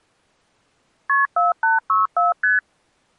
Multi-frequency trunk signalling (R1, as on North American trunks), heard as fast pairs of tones, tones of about 160 ms. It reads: KP 4864 ST